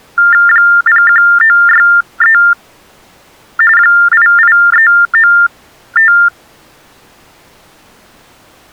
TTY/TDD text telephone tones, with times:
0.5-2.4 01963
3.8-6.1 88395

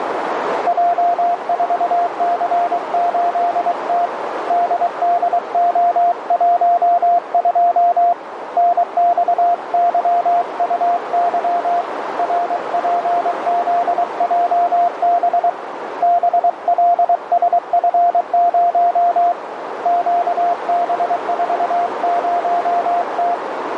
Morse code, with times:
0.7-4.1 J4C8T
4.5-8.1 DDO12
8.6-11.8 NXYUY
12.2-15.5 RPZJB
16.0-19.3 BLSF0
19.9-23.3 QB40T

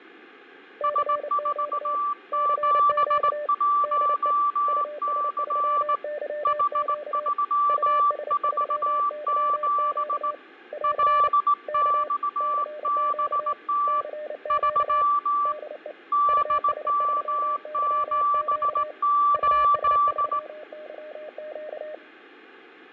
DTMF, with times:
none

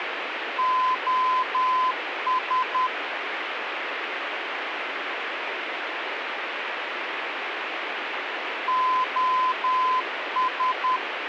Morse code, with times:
0.6-2.9 OS
8.7-11.0 OS

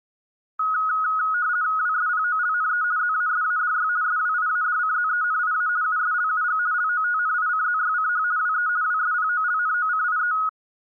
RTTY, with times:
1.8-2.8 WSPOLNE
3.0-3.9 ZASADY
4.0-5.7 SWIADCZENIA
5.8-6.6 USLUG
6.7-8.2 LOTNICZYCH
8.4-8.7 WE
8.8-10.3 WSPOLNOCIE

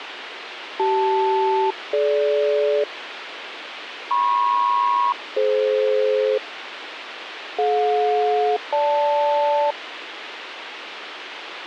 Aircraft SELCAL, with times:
0.8-2.8 CL-DG
4.1-6.4 MP-DF
7.6-9.7 DJ-GL

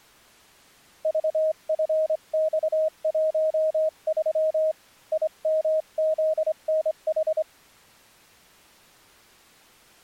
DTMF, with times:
none

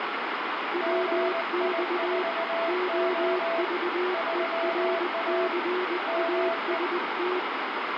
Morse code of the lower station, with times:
0.7-2.2 WX
2.7-7.4 OVERCAST

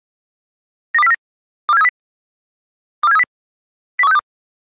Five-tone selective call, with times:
0.9-1.1 92049
1.7-1.9 24730
3.0-3.2 24730
4.0-4.2 01362

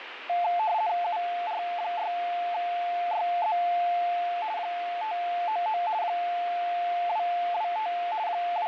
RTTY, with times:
1.0-3.6 UR6YZ
4.6-5.8 599
6.0-7.9 225
8.3-8.7 …

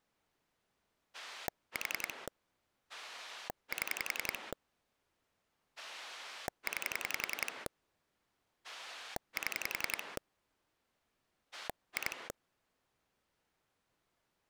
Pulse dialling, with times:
1.1-2.3 4
2.9-4.5 7
5.8-7.7 9
8.6-10.2 7
11.5-12.3 2

